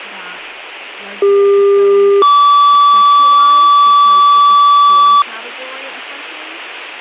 Two-tone page, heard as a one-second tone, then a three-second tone, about 400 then 1150 Hz, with speech in English.